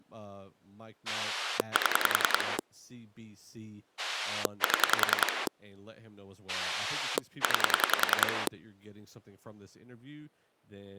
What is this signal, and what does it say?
Pulse dialling, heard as a rotary dial, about 10 pulses a second, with speech in English. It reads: 7 7 9